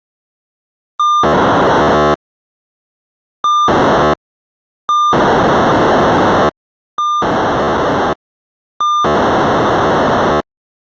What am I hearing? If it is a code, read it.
POCSAG pager data (2400 baud), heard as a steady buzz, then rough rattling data.